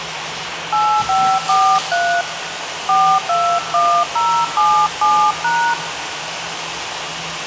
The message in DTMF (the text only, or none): 8543 421077#